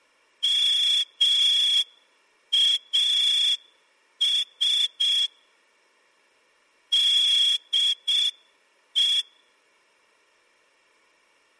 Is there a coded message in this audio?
Yes: Morse code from 0.4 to 9.3 s, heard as a whistle, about 6 wpm. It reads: MAS DE